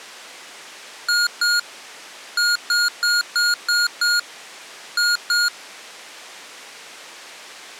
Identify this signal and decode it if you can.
Beep code, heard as beeps from a small speaker, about 1430 Hz. 2-6-2.